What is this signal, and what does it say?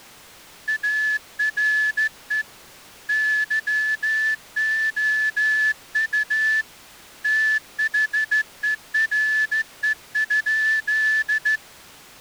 Morse code, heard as a whistle, hand-sent with a straight key, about 14 wpm. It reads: ARE YOU THERE?